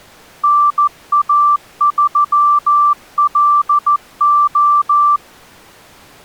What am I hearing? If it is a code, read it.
Morse code, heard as a keyed tone, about 14 wpm, 1170 Hz. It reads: NA3LO